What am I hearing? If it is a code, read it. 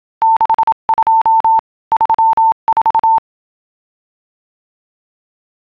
Morse code, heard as a keyed tone, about 27 wpm, 900 Hz. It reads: 62 34